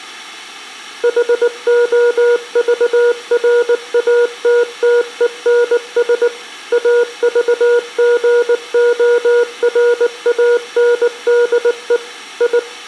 Morse code, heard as a keyed tone, machine-sent, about 19 wpm, 480 Hz, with room echo. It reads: HOVRATTENS AVGORANDE I